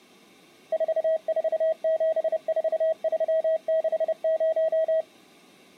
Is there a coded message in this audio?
Yes: Morse code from 0.7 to 5.1 s, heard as a keyed tone, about 30 wpm, 640 Hz. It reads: 4474360